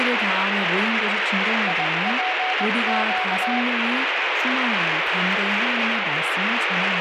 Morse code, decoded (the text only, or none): IPQ